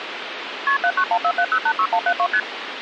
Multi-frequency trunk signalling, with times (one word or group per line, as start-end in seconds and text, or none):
0.7-0.8 KP
0.8-2.3 79147086172
2.3-2.4 ST